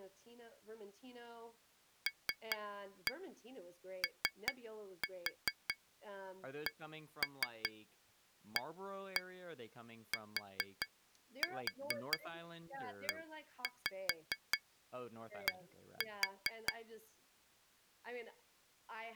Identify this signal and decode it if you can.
Tap code, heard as taps on glass, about 4 knocks a second, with speech in English. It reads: LOCATED